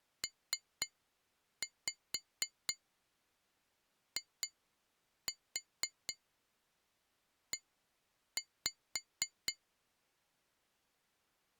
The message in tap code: PIE

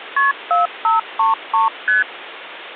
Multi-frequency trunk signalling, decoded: KP 4533 ST

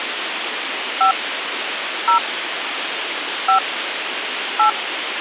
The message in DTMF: 5 0 5 8

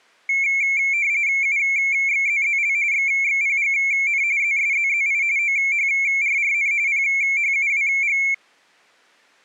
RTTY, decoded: UXZZL XXPGN ZSZZI OHRRN PHUWG

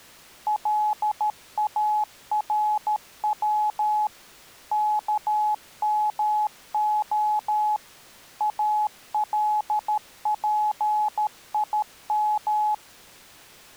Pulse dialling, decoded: none

